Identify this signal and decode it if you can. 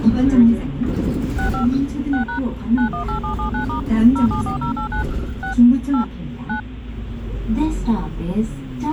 DTMF, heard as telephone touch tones, dialled by machine, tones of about 110 ms, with the noise inside a bus. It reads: 65 6# 918779* 074089 6 8 9